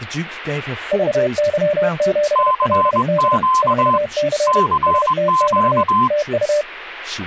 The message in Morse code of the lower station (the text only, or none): VY7LD 4C STX TU